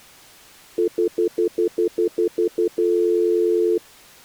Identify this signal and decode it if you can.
Telephone call progress tone (North American plan), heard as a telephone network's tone, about 350, 440 Hz, 0.1 s on and 0.1 s off. Stutter dial tone.